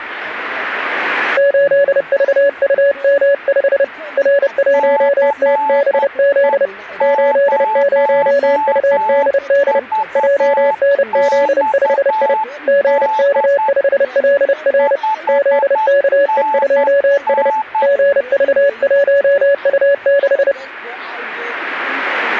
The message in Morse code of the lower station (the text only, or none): 8VUM5 R1TBZ 80UDD JNZ5I GK5LR ZKE2S GV1U6